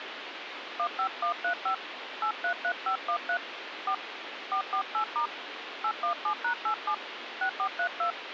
DTMF, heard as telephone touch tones, dialled by hand, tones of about 90 ms, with phone line noise. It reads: 15135 833513 4 448* 817#87 6432